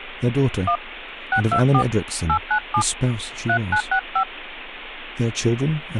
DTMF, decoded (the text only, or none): 1 624 897 3965